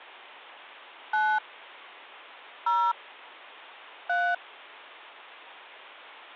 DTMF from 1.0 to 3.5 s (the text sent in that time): 9 0